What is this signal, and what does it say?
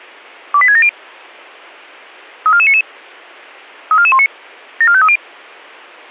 Five-tone selective call (ZVEI), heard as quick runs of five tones, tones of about 70 ms. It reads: 28670 34499 34419 74530